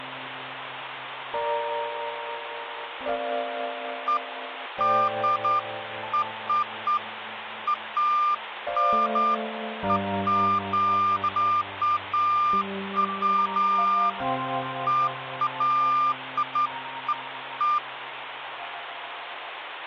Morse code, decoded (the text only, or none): none